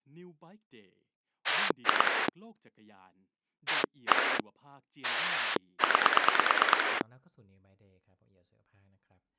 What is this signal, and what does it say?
Pulse dialling, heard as a rotary dial, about 9 pulses a second, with speech in Thai. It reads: 2 1 9